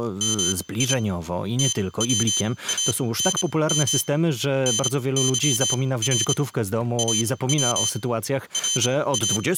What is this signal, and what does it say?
Morse code (Persian alphabet), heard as a high beeper, machine-sent, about 27 wpm, spaced as for 19 wpm, 3100 Hz, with room echo and speech in Polish. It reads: می توانم نظر او را